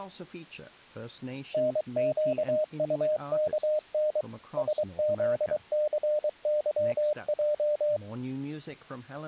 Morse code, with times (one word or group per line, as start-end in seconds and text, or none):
1.5-4.2 NQUKN
4.6-8.0 SZCYJ